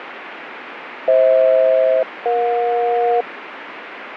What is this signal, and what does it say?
Aircraft SELCAL, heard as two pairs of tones, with radio static. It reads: FH-EJ